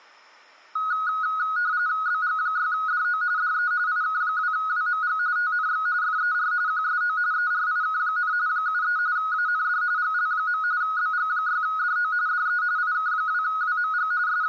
RTTY (45.45 baud, 170 Hz shift), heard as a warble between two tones, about 1360 Hz centre. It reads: BG6DO DE IK2WMG TNX FER QSO ERIK, 73 AND GL. BG6DO DE IK2WMG …